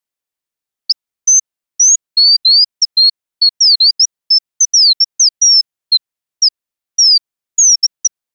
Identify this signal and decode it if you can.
Bird-like chirps. There is no code.